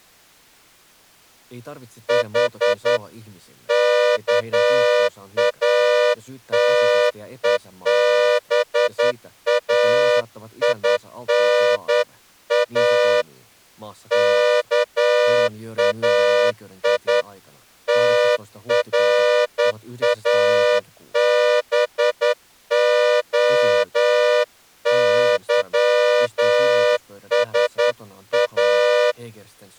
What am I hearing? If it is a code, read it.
Morse code (Greek alphabet), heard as a horn, hand-sent with a straight key, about 10 wpm. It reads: Η ΚΑΤΕΒΑΙΝΑ ΚΑΙ ΤΡΑΒΟΥΣΑ